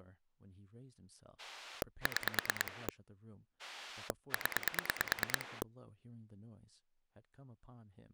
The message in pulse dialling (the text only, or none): 6 0